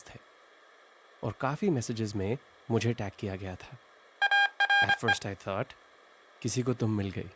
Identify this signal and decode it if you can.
Morse code, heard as electronic beeps, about 25 wpm, 800 Hz, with speech in Hindi. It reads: ARE